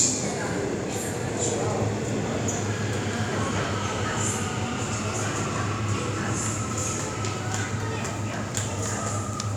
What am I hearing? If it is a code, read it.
The noise of a subway station. There is no code.